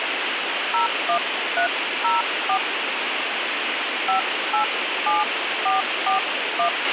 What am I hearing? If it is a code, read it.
DTMF, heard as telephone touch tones, dialled by hand, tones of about 120 ms, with radio hiss and a squelch burst at the end. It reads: 01304 587441